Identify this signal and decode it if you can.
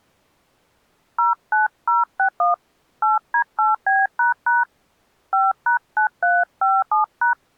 DTMF, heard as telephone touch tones, dialled by hand, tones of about 150 ms. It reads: 09061 8D8B## 5#9357#